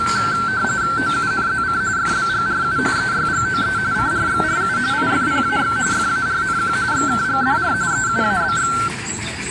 RTTY (45.45 baud, 170 Hz shift), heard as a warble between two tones, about 1450 Hz centre, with the noise of a park. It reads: OUNZC FBGRU EYGOE CRXRU IFPAX FARNQ XKGDR EUABX